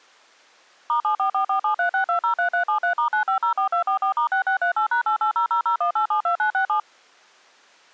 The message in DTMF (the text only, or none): *7444736203373*9504244*6638#880001872967